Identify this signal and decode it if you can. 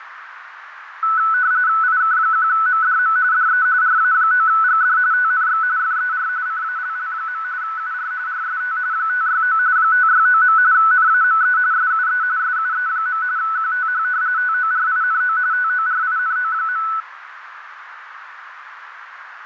RTTY (45.45 baud, 170 Hz shift), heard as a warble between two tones, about 1400 Hz centre, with radio static, fading and a narrow filter. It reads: IK1MDM DE RA9GD TNX FER CALL. UR RST 569 569. NAME SUE SUE. QTH TORINO TORINO.